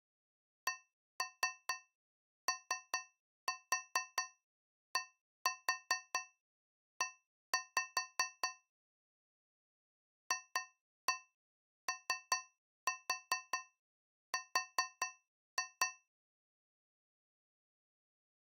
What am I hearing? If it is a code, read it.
Tap code, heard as taps on a metal pipe, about 4 knocks a second. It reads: CODE FOR